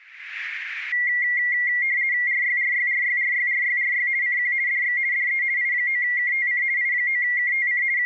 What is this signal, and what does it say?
RTTY (50 baud, 170 Hz shift), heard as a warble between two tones, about 2050 Hz centre, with radio static. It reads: RYRYRYRYRYRY CQ DX DE I9KTC I9KTC …